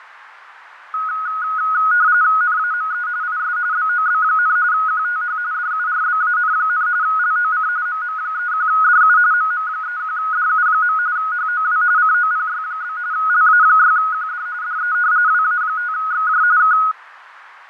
RTTY (45.45 baud, 170 Hz shift), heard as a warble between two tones, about 1360 Hz centre, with radio static, fading and a narrow filter. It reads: NAME IS BOB, QTH DURBAN, LOC MM31DU MM31DU. HOW COPY? LA6QD DE WA5XJ K